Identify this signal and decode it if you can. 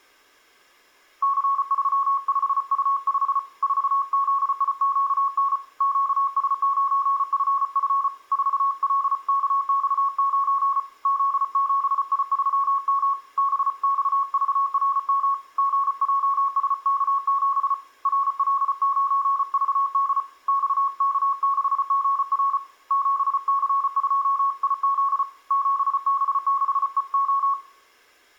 Morse code, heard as a keyed tone, hand-sent with a paddle, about 34 wpm, 1100 Hz, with room echo. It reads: C35U5 4ZIQN QS9FF 4LKX9 Z7I3M BXVRM GJSK7 RL9VD XK6GR 7C2IZ 7B6EO